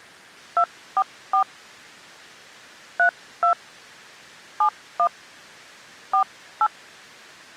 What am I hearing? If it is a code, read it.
DTMF, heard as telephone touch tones, dialled by hand, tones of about 80 ms. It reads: 244 32 71 48